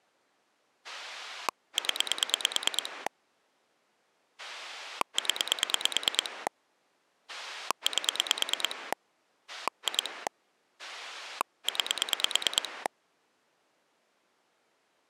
Pulse dialling, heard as a rotary dial, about 9 pulses a second. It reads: 0 0 8 2 9